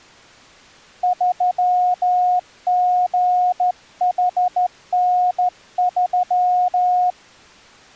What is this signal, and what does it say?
Morse code, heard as a keyed tone, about 13 wpm, 720 Hz. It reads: 3GHN3